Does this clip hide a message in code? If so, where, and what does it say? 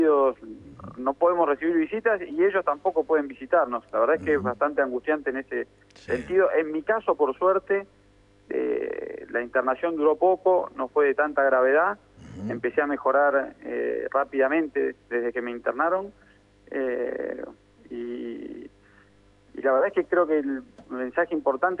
No.